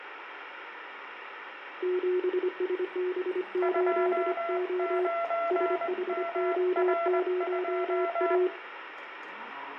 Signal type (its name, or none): Morse code